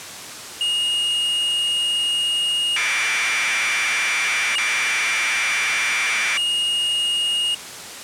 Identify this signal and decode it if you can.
Commodore tape loading (standard loader), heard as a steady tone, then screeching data.